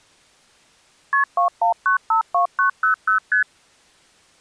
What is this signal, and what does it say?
Multi-frequency trunk signalling (R1, as on North American trunks), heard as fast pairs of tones, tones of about 110 ms. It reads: KP 21952900 ST